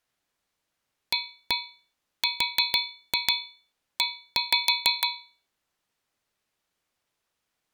Tap code, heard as taps on a metal pipe, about 6 knocks a second. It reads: ARE